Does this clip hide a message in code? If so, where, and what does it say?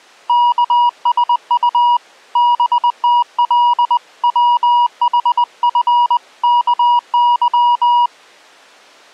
Yes: Morse code (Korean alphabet) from 0.2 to 8.1 s, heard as a keyed tone, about 20 wpm, 960 Hz. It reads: 예 덕분에